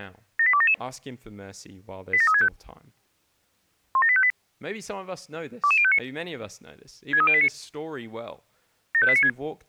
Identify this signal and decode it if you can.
Five-tone selective call (ZVEI), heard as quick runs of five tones, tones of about 70 ms, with speech in English. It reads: 78277 87365 17858 22059 63089 75896